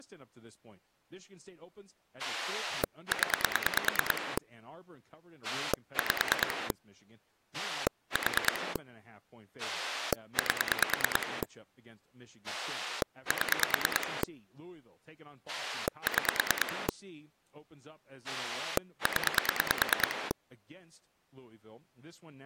Pulse dialling, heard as a rotary dial, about 9 pulses a second, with speech in English. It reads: 0 5 4 8 7 6 0